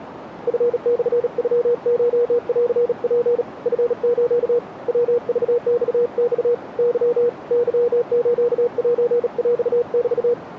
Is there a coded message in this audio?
Yes: Morse code (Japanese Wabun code) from 0.4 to 10.4 s, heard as a keyed tone, hand-sent with a bug key, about 37 wpm, 480 Hz, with radio static. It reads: チモノコンツ チス ヤクママ ケ ケスセヰメ